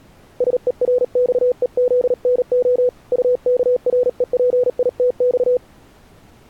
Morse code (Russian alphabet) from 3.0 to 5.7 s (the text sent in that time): УКРЕПИТЬ